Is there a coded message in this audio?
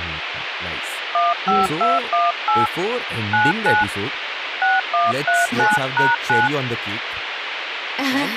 Yes: DTMF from 1.1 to 6.5 s, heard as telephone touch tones, dialled by hand, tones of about 180 ms, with phone line noise and speech in English. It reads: 15218 99 6139#9